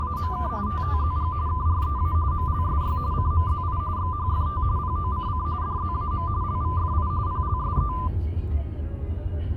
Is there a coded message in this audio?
Yes: RTTY (45.45 baud, 170 Hz shift) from 0.0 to 8.1 s, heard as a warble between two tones, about 1100 Hz centre, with the noise inside a car. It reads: … TTZG KREA MLSY CMZI XHFT POCC DZAM LVFI PLSE